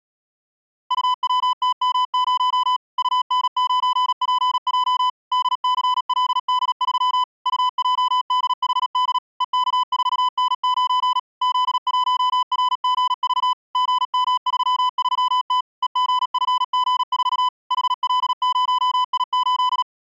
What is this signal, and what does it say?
Morse code, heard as a keyed tone, machine-sent, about 37 wpm, 1000 Hz. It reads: UWTM0 UN9PJ DCLD3 UJDHD EK4N9 Z1RGV GM33T EGFG4 HL0I8